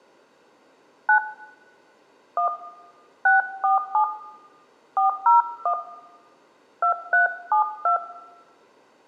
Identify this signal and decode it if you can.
DTMF, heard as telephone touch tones, dialled by hand, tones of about 110 ms, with room echo. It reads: 9 1 647 401 2372